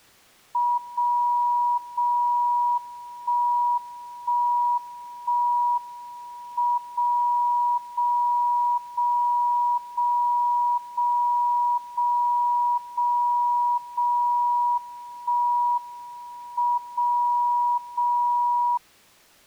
Radio time signal (WWVB), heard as a tone whose level steps once a second, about 970 Hz. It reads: 0 0 1 1 1 M 0 0 0 0 0 0 0 0 1 M 0 0